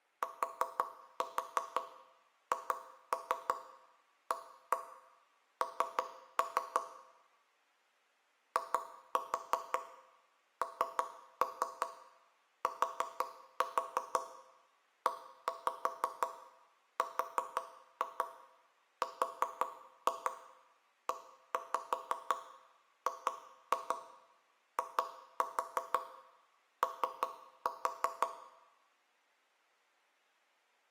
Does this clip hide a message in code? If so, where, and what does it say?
Yes: tap code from 0.2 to 28.3 s, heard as knocks on wood, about 5 knocks a second, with room echo. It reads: THAN INTERREGIO